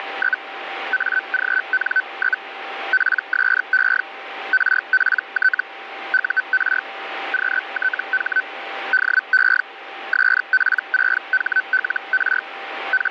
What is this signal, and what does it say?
Hellschreiber (Feld-Hell, 122.5 baud), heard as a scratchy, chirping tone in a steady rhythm, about 1500 Hz, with radio static and a steady whistle near 780 Hz. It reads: … AGN? PSE RPT UR QTH DE SP6HLR …